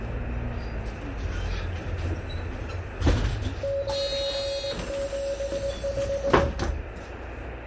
Morse code, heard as a keyed tone, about 20 wpm, 560 Hz, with radio static, room echo and the noise inside a bus. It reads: 975